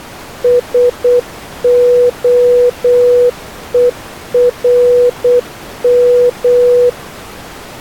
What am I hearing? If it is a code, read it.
Morse code, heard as a keyed tone, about 8 wpm, 490 Hz. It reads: SOERM